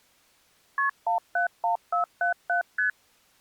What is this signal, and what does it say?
Multi-frequency trunk signalling (R1, as on North American trunks), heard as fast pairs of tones, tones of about 120 ms. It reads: KP 171477 ST